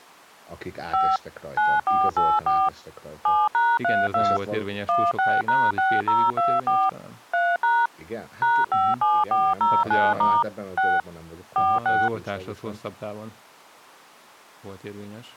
DTMF, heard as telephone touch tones, dialled by machine, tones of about 220 ms, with speech in Hungarian. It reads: 5 9484 7#32 16#6024 3# #57409* 6 46